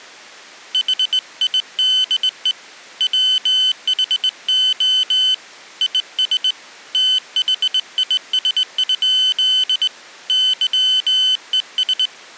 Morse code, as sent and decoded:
.... .. -.. . / .-- .... --- / .. ... / - .... .. ... ..--.. / -.-- . ...
HIDE WHO IS THIS? YES

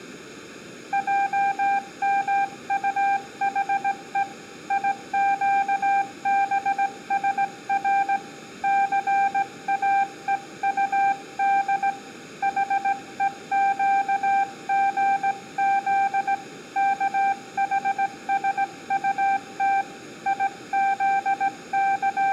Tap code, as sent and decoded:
none

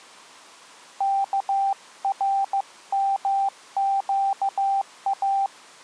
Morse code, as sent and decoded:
-.- .-. -- --.- .-
KRMQA

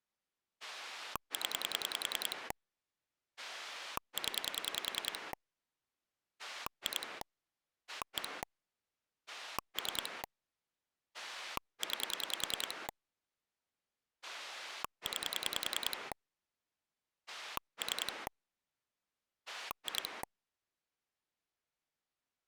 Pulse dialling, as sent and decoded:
10 / 10 / 2 / 1 / 3 / 9 / 9 / 3 / 2
0 0 2 1 3 9 9 3 2

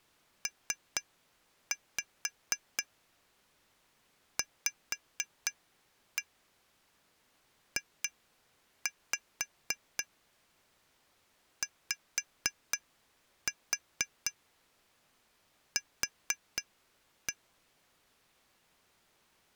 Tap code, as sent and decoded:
3-5 5-1 2-5 5-4 4-1
PVJYQ

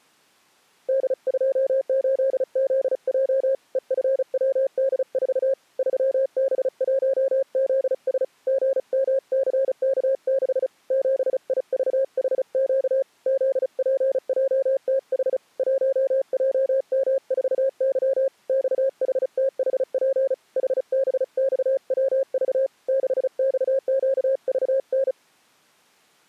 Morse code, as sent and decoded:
-.. ..--- ---.. --.. .--- / . ..-. .-- -.. ....- / ...-- -... .---- --.. ... / --. -- -.-. -.- -.... / --... .. ...- .... --.- / --.. .--. .--- - .... / .---- .--- -- ....- -.-- / -..- .... - .... .--. / .... -... -..- .-- ...- / -.... -..- --.- ...- -.
D28ZJ EFWD4 3B1ZS GMCK6 7IVHQ ZPJTH 1JM4Y XHTHP HBXWV 6XQVN

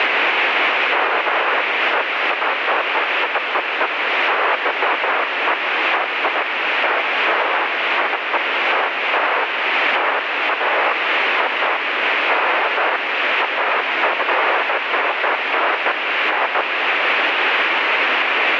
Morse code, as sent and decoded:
none

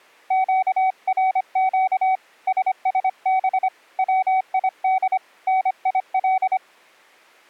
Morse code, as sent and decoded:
--.- .-. --.- / ... ... -... / .-- .. -.. / -. .. .-..
QRQ SSB WID NIL

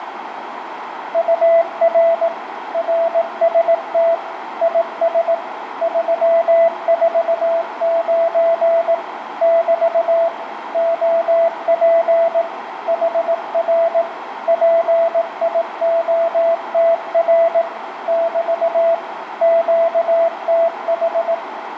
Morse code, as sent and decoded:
..- .-. / .-. ... - / .. ... / ...-- ....- ----. / -...- / --- .--. / .... .-. / .--. .. --- - .-. / -...- / --.- - ....
UR RST IS 349 <BT> OP HR PIOTR <BT> QTH

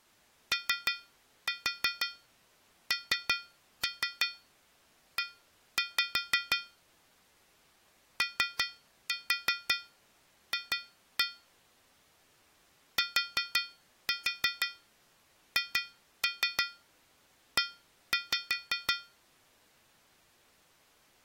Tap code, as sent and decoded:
3-4 3-3 1-5 / 3-4 2-1 / 4-4 2-3 1-5
ONE OF THE

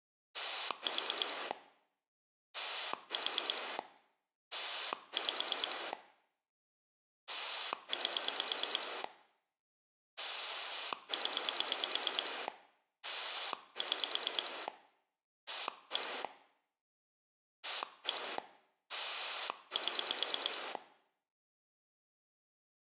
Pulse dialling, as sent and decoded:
4 / 4 / 5 / 8 / 10 / 6 / 1 / 1 / 7
4 4 5 8 0 6 1 1 7

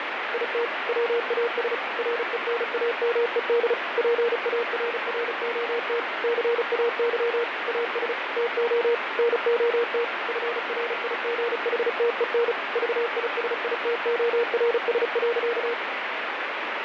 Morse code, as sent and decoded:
.. - / .-- .- ... / .-. . -. .- -- . -.. / .--. .- .-. .-. --- - / -.-. .- -.-- / .- ... / - --- / -. --- - / ..-. .-. .. --. .... - . -. / ...- .. ... .. - --- .-. ... .-.-.-
IT WAS RENAMED PARROT CAY AS TO NOT FRIGHTEN VISITORS.

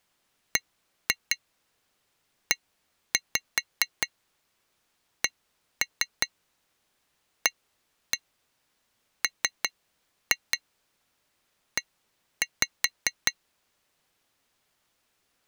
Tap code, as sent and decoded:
1-2 1-5 1-3 1-1 3-2 1-5
BECAME

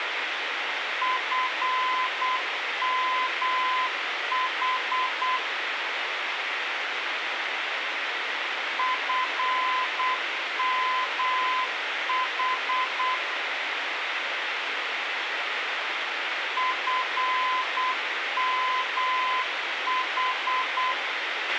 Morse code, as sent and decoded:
..-. -- .... / ..-. -- .... / ..-. -- ....
FMH FMH FMH

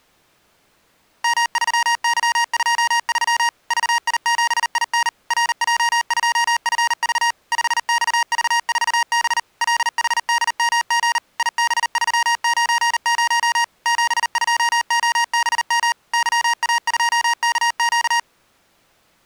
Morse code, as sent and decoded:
-- ...-- -.-- ..--- ...-- / ...- .. --... .. -. / .-. .--- ..--- ..-. ...- / ..... -..- ...- ....- -... / .-.. .... -.. -- --. / .. -... ...-- ----. ----- / --... ..--- --- -... -- / -.-- .- ..--- -.- --.-
M3Y23 VI7IN RJ2FV 5XV4B LHDMG IB390 72OBM YA2KQ

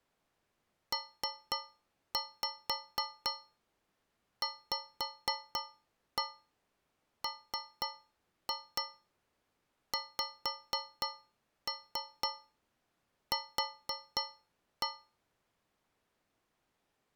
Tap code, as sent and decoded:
3-5 5-1 3-2 5-3 4-1
PVMXQ

